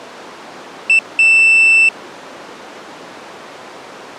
Beep code, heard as a piezo beeper, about 2650 Hz. 1 short, 1 long.